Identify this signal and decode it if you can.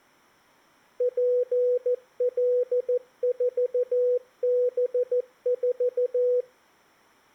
Morse code, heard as a keyed tone, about 14 wpm, 490 Hz. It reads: PL4B4